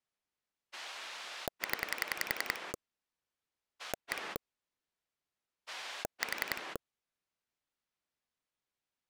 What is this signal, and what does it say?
Pulse dialling, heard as a rotary dial, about 10 pulses a second. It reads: 0 1 4